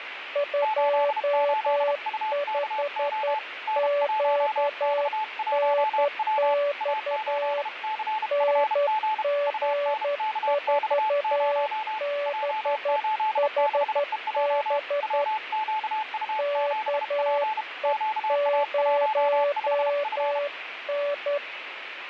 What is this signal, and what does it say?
Morse code, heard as two keyed tones, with radio static. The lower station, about 11 wpm, 580 Hz: 25QNX NG4BHB KE0N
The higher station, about 32 wpm, 870 Hz: 88UKO N1X1W A8CFG UNKX0 J86EJ WQU7P QA15F